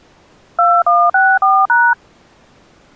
DTMF, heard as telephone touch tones, dialled by machine, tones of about 240 ms. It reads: 2164#